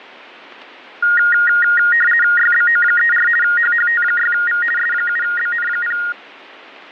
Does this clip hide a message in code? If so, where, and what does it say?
Yes: RTTY (50 baud, 450 Hz shift) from 1.0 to 6.1 s, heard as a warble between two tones, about 1650 Hz centre, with radio static. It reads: YBO34 HHT6V S7BN0